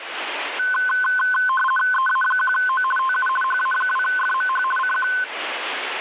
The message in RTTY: EA1O TU HA2FMH CQ

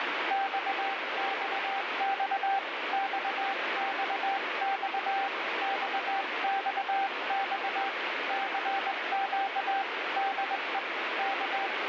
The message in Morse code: XXX XXX XXX CQ DE …

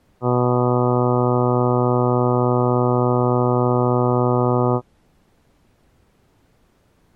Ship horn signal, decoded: 1 long

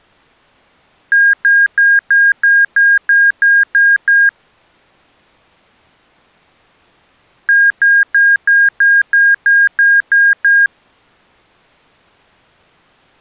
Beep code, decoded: 10 short

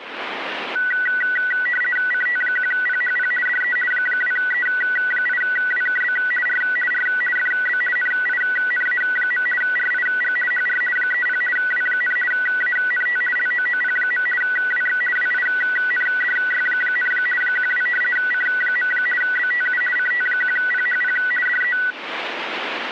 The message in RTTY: CT1PHP DE 2E8WKB R R FB NINA. RIG HR 30 W, ANT LOOP. WX WINDY, 12 C. BTU CT1PHP DE

